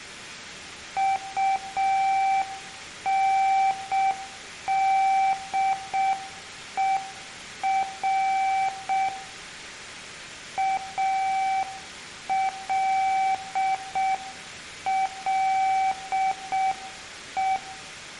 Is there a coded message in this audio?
Yes: Morse code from 0.9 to 17.6 s, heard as a keyed tone, hand-sent with a paddle, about 6 wpm, 770 Hz, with room echo. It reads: UNDER ALLE